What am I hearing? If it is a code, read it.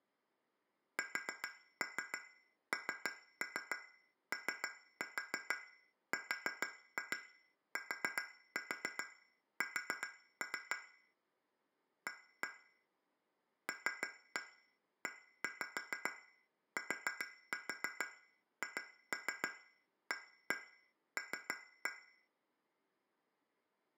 Tap code, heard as taps on glass, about 7 knocks a second, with room echo. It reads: SNORTS A LETHAL